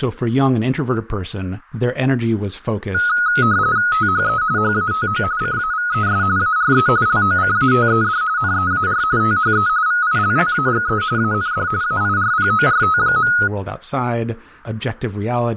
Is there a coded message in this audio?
Yes: RTTY (45.45 baud, 170 Hz shift) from 2.9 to 13.5 s, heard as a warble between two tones, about 1360 Hz centre, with speech in English. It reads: THE HATO CAVES ARE LOCATED NEAR THE VILLAGE AND AIRPORT.